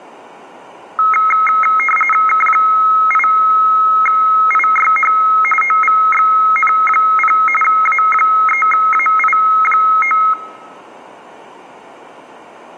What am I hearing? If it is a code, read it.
RTTY (45.45 baud, 850 Hz shift), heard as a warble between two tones, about 1700 Hz centre. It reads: K8IYH OVXN0 A3AI9